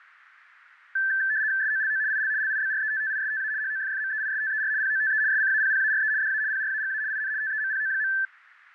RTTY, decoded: SOLO IL LIBRETTISTA HOFFMEISTER POTE SCAPPARE DA PRAGA IN TEMPO.

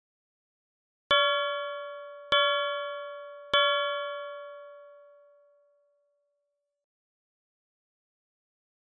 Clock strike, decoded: 3

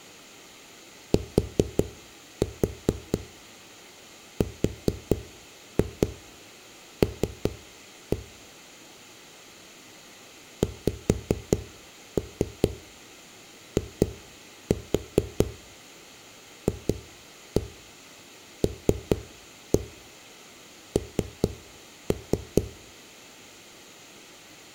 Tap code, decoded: TRL XIFLN

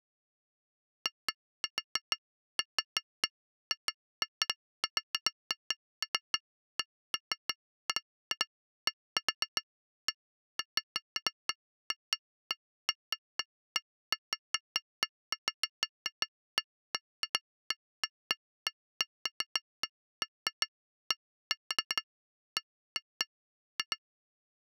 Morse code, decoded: none

